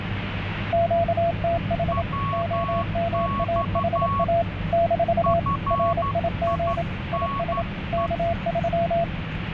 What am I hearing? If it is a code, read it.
Morse code, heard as two keyed tones, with radio static and the noise inside a car. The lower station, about 27 wpm, 680 Hz: QTH OMAHA - RIG IS K3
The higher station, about 12 wpm, 1110 Hz: WX FINE